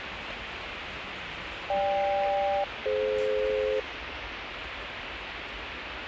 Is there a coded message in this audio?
Yes: aircraft SELCAL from 1.7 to 3.8 s, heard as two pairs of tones, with radio hiss and the noise of a park. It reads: GK-DF